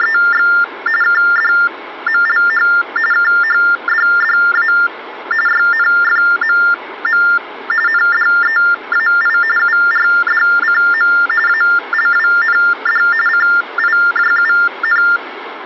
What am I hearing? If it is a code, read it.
TTY/TDD text telephone tones (45.45 baud Baudot), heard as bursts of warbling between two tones, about 400 Hz shift, 1600 Hz centre, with phone line noise. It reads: … KDMLH KHDDA YNFMM NDEAI URDCM ALWND CIJUN